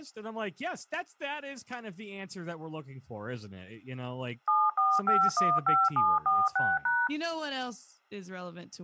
DTMF, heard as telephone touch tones, dialled by machine, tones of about 220 ms, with speech in English. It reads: 74515746#